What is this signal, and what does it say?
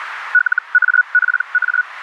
Hellschreiber (Feld-Hell, 122.5 baud), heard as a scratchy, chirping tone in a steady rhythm, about 1470 Hz, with radio static and a narrow filter. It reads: LAPA